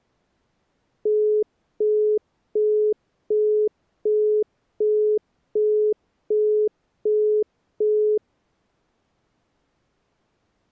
Telephone call progress tone (as in the UK, Australia and similar networks), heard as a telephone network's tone, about 420 Hz, 0.375 s on and 0.375 s off. Busy tone.